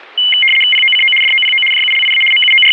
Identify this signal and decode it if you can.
RTTY (75 baud, 850 Hz shift), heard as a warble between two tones, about 2550 Hz centre. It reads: POCO DOPO JULIA …